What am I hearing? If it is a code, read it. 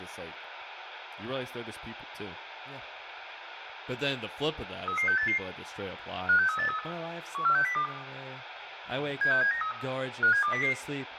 Five-tone selective call (CCIR), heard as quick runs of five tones, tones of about 100 ms, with radio hiss, room echo and speech in English. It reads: 33688 56383 14602 76793 57200